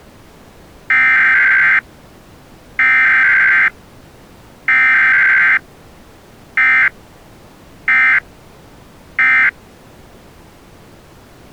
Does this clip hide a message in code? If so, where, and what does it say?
Yes: Emergency Alert System (SAME) tones (header bursts, then end-of-message bursts) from 0.9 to 9.5 s, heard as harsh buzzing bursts, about 520.83 baud.